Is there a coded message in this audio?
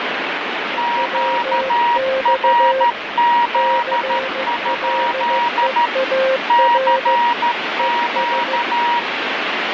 Yes: Morse code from 0.7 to 9.1 s, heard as two keyed tones, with heavy radio static. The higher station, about 13 wpm, 950 Hz: QRZ? CQ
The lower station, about 15 wpm, 530 Hz: WX CLEAR ES